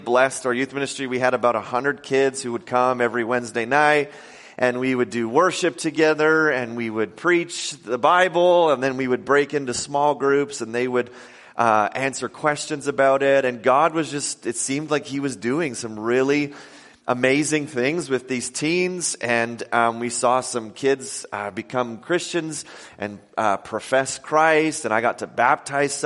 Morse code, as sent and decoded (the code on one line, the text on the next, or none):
none